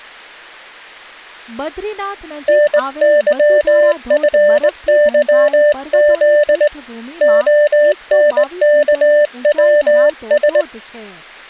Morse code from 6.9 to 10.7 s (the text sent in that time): ONKWS